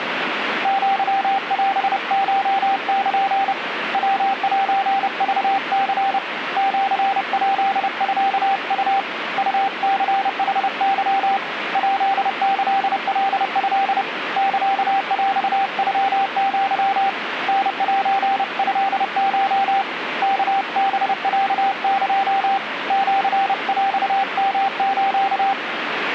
Morse code (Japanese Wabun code), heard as a keyed tone, hand-sent with a paddle, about 30 wpm, 780 Hz, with radio static. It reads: アオコル ヤセクニ シヱミウ ウニヌケ ヱキカト サヰノア タセトコ ワハロエ シヰヨス